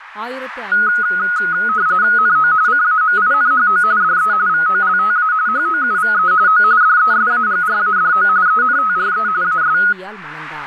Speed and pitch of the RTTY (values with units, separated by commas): 45.45 baud, 170 Hz shift, 1360 Hz centre